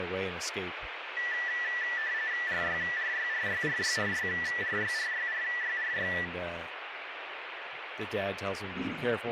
RTTY (45.45 baud, 170 Hz shift), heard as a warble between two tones, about 1850 Hz centre, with radio static and speech in English. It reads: RYRYRYRYRYRYRYRYRY